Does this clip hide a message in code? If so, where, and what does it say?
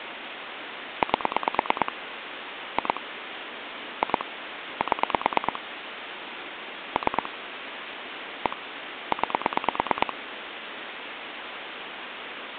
Yes: pulse dialling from 1.0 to 10.1 s, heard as clicks on a phone line, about 9 pulses a second, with phone line noise. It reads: 8 2 2 7 3 1 9